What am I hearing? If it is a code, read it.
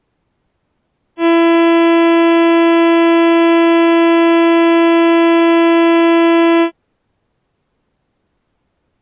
Ship horn signal, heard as a ship's horn, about 340 Hz. 1 long. At sea: a vessel nearing a blind bend, or under power and making way in fog.